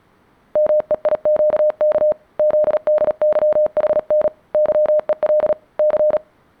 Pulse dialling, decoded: none

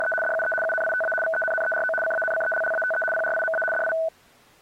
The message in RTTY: … DUE UNITA VENNERO CANCELLATE PRIMA DI

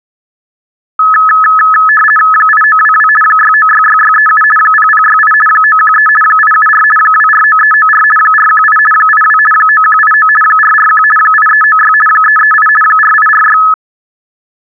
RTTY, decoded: 8922 6966637 0068 913 874 249394 418 82 9189 441 8396 338 4846

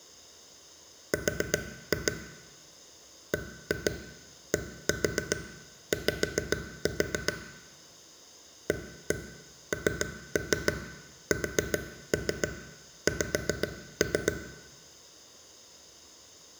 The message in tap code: R BDY ANSX

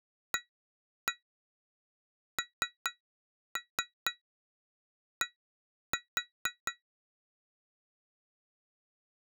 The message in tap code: AND

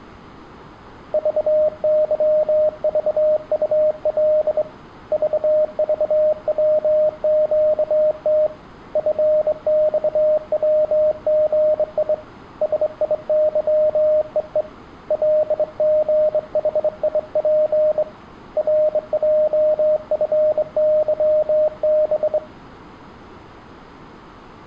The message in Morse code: VYVUL VVWQT FXWGI SIYEE LGHIP RJFYB

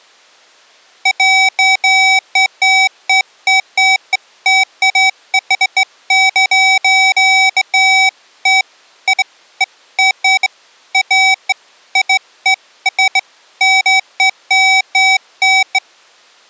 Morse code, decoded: none

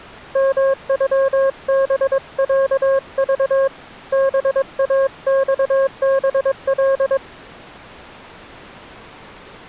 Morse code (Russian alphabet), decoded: МЮБЯЖ БАЬБЛ

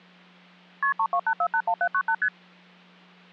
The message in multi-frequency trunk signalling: KP 328481798 ST

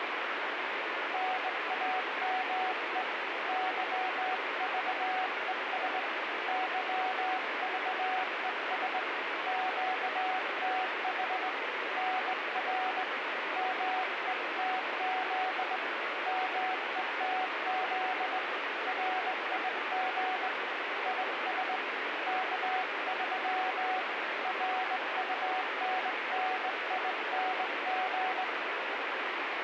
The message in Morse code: NAME YVES YVES QTH NR METZ METZ RIG IS K3 RUNNING

